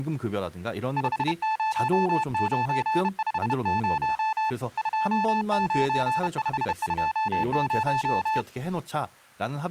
Morse code, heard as a keyed tone, hand-sent with a bug key, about 31 wpm, 880 Hz, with speech in Korean. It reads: 50950 29520